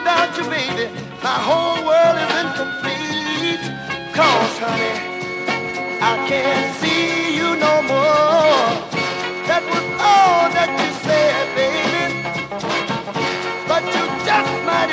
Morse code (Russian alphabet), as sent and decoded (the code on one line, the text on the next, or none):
none